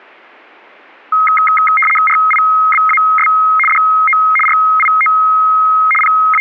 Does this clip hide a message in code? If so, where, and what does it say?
Yes: RTTY (75 baud, 850 Hz shift) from 1.1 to 6.4 s, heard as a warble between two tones, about 1700 Hz centre. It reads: RIBAS DO RIO …